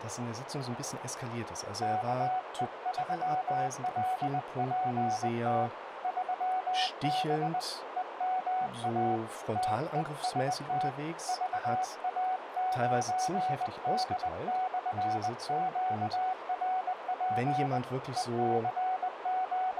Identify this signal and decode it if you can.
Morse code, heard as a keyed tone, hand-sent with a paddle, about 20 wpm, 750 Hz, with radio static, a narrow filter and speech in German. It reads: KE3LPT 3B EMA TEST VA9D/QRP …